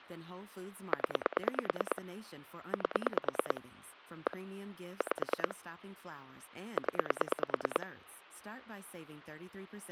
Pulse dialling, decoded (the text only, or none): 0 8 1 5 0